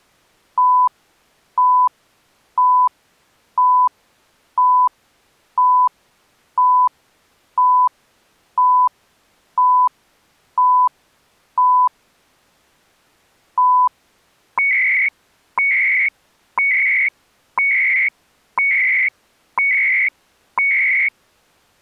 Radio time signal (CHU, Canada), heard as beeps and data bursts, one a second.